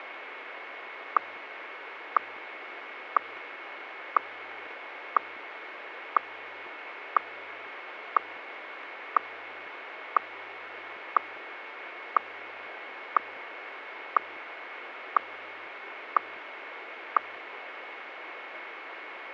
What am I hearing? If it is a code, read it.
Radio time signal (WWVH, Hawaii), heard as ticks, one a second, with radio static.